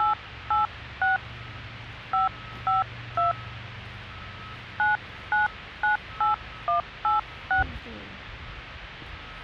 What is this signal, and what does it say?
DTMF, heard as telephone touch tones, dialled by hand, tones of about 140 ms, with the noise of a residential street. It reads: 886 552 9998186